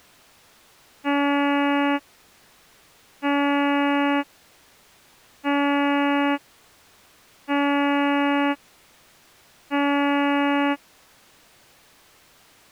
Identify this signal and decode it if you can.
Ship horn signal, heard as a ship's horn, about 280 Hz. 5 short. At sea: I doubt that you are doing enough to avoid a collision.